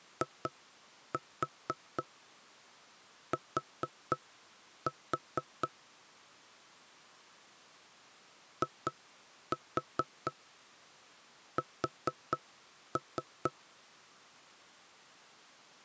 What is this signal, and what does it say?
Tap code, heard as knocks on wood, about 4 knocks a second. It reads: IT IS